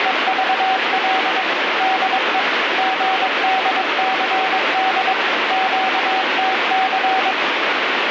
Morse code, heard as a keyed tone, machine-sent, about 22 wpm, 760 Hz, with heavy radio static. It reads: … DE GDCD QTC